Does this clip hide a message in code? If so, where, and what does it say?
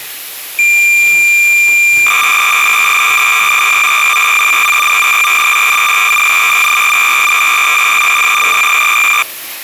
Yes: cassette data (Kansas City type), 300 baud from 0.6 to 9.2 s, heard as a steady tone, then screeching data, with the noise of a restroom.